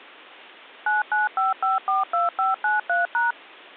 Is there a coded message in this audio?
Yes: DTMF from 0.9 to 3.3 s, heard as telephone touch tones, dialled by machine, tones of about 160 ms. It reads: 995542593#